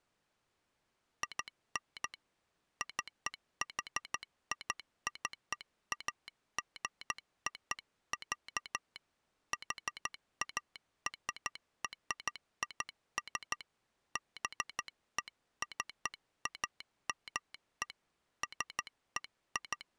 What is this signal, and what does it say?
Morse code (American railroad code), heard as a telegraph sounder, hand-sent with a straight key. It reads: IN CHICAGO, HARRIS BECAME …